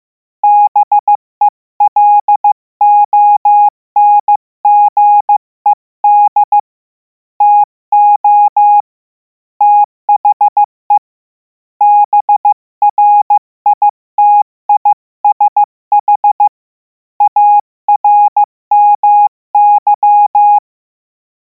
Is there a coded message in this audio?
Yes: Morse code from 0.4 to 20.6 s, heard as a keyed tone, hand-sent with a paddle, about 15 wpm, 830 Hz. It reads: BELONGED TO THE BRITISH ARMY